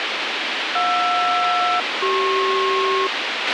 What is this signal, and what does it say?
Aircraft SELCAL, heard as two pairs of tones, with radio hiss and a squelch burst at the end. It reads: JR-CP